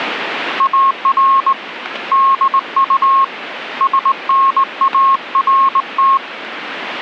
Morse code, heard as a keyed tone, hand-sent with a straight key, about 19 wpm, 1080 Hz. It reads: AR DU SNART